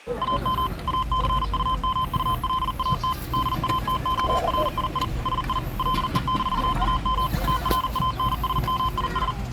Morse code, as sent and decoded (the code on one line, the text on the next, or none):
.- -- / .- -.-. ..- -- ..- .-.. .- - / -.. .- - --- .-. .. .. / ... .. / .-.. . -....- .- -- / - .-. .- -. ... -- .. ...
AM ACUMULAT DATORII SI LE-AM TRANSMIS